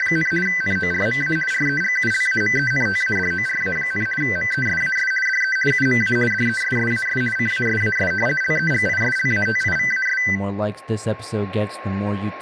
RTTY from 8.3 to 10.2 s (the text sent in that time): LEGISLATIVAS